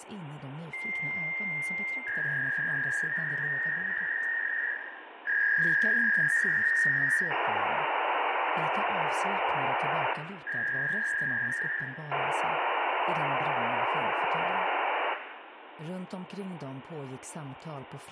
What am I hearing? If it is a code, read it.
Fax machine handshake, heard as a long tone, a warble and hiss, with phone line noise and room echo.